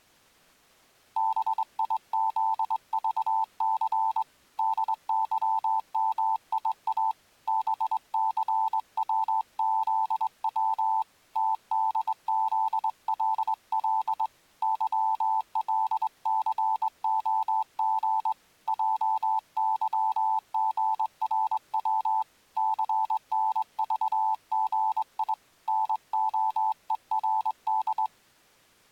Morse code, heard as a keyed tone, hand-sent with a straight key, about 22 wpm, 880 Hz. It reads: BIZVC DYMIA BCWZW TDZLL YLCOG JYGRW CNVGI NOERD